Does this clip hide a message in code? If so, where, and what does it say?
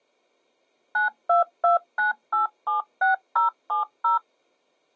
Yes: DTMF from 0.9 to 4.2 s, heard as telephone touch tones, dialled by machine, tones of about 130 ms. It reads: 9229876070